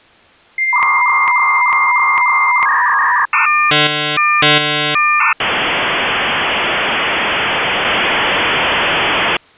Dial-up modem handshake (V.34 or later), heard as a whistle, warbles, then hiss.